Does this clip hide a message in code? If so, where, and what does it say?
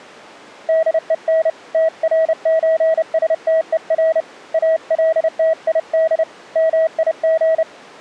Yes: Morse code (with Danish letters) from 0.6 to 7.7 s, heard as a keyed tone, hand-sent with a paddle, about 30 wpm, 640 Hz. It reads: DEN TRØSTER ALTID MIG